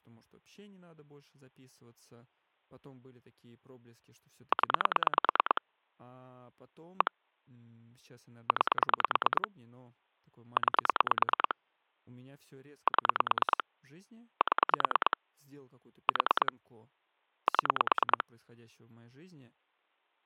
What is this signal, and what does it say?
Pulse dialling, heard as clicks on a phone line, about 9 pulses a second, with speech in Russian. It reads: 0 1 9 9 7 7 4 7